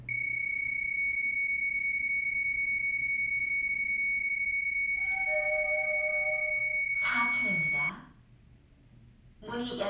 PSK31 (31.25 baud), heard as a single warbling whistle, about 2250 Hz, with the noise inside a lift.